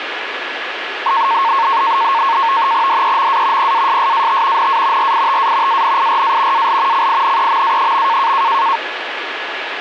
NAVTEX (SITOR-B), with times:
2.9-3.7 DEMA
3.6-4.7 PASSAT
4.6-5.1 NA
5.0-5.8 RITA
5.7-6.7 ANIRA
6.5-7.1 AL
6.9-8.3 CINEMA.

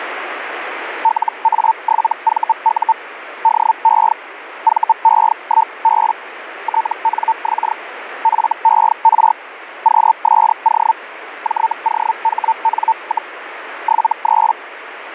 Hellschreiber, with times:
1.0-2.9 LA7VU
3.4-4.1 DE
4.6-6.1 VE1B
6.6-7.7 TNX
8.2-9.3 FER
9.8-10.9 QSO
11.4-13.3 JOHN,
13.8-14.5 73

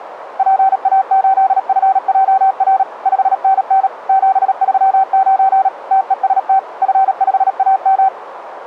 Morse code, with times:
0.4-2.8 PA8FJR
3.1-3.9 5NN
4.1-5.7 739
5.9-6.6 TEST
6.8-8.1 F5AM

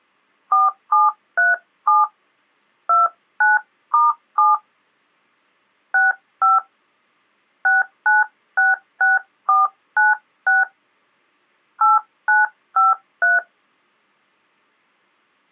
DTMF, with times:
0.5-2.0 4737
2.9-4.5 29*7
5.9-6.6 65
7.7-10.6 6966496
11.8-13.4 8953

